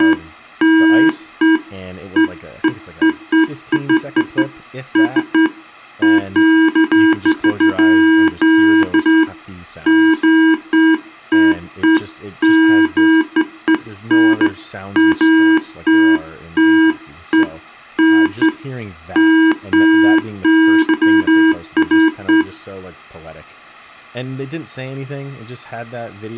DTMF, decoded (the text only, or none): none